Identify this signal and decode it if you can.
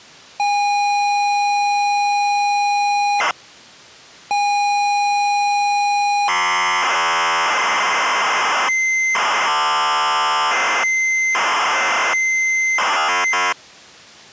ZX Spectrum tape loading, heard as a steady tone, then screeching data.